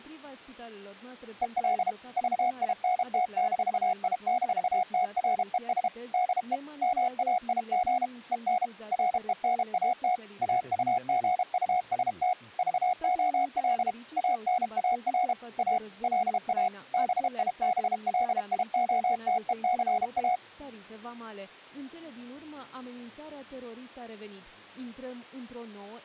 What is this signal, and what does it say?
Morse code, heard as a keyed tone, machine-sent, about 32 wpm, 730 Hz. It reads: EL VINT-I-TRES DE MAIG EN RENAT AUGUST VOL ANAR A LA BIBLIOTECA